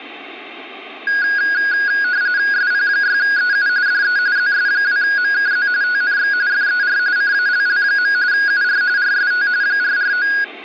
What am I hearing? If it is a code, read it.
RTTY (45.45 baud, 170 Hz shift), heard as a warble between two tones, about 1550 Hz centre. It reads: SP6EU DE ZS2MKZ TNX FER CALL. UR RST 449